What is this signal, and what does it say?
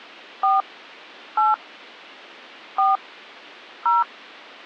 DTMF, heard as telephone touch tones, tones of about 170 ms. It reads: 4 8 4 0